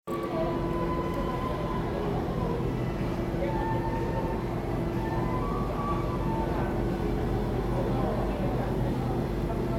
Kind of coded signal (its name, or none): none